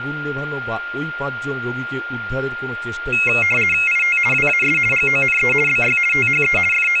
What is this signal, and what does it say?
RTTY (50 baud, 450 Hz shift), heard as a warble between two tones, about 2350 Hz centre, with a steady whistle near 1410 Hz and speech in Bangla. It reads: IT WAS GONE BY THE …